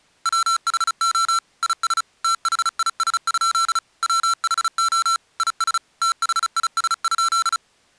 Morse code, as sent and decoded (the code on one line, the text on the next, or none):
.-- .... --- / .. ... / - .... .. ... ..--.. / .-- .... --- / .. ... / - .... .. ... ..--..
WHO IS THIS? WHO IS THIS?